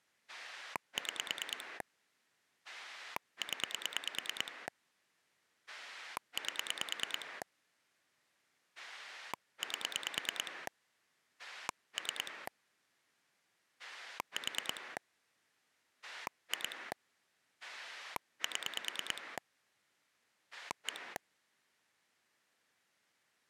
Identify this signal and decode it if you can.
Pulse dialling, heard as a rotary dial, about 9 pulses a second. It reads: 6 0 8 8 3 4 2 7 1